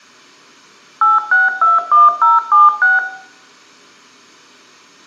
DTMF, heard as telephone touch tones, dialled by machine, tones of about 170 ms, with room echo. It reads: 8621076